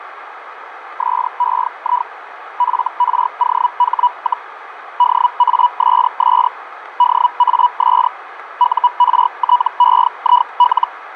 Hellschreiber (Feld-Hell, 122.5 baud), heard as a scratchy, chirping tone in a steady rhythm, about 980 Hz, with radio static, fading and a narrow filter. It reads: SEI FROH, DASS DAS URTEIL